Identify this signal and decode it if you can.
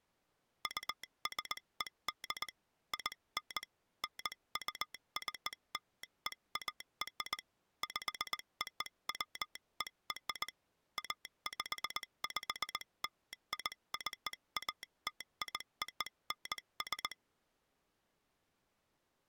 Morse code (American railroad code), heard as a telegraph sounder, hand-sent with a straight key. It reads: USED IN NUCLEAR POWER APPLICATIONS